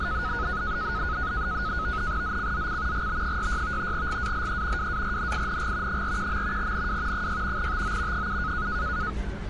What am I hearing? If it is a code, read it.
NAVTEX (SITOR-B), 100 baud, 170 Hz shift, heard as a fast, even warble, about 1360 Hz centre, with street noise. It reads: ZCZC GB66 GALE WARNING 41. NW 6 TO 7